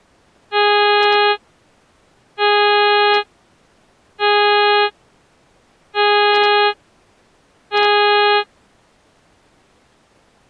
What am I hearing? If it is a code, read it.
Ship horn signal, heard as a ship's horn, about 410 Hz. 5 short. At sea: I doubt that you are doing enough to avoid a collision.